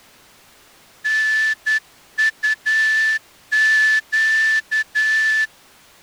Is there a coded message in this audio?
Yes: Morse code (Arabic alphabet) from 1.0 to 5.5 s, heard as a whistle, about 10 wpm. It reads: نطق